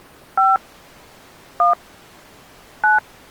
DTMF, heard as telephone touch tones, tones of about 160 ms. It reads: 5 1 9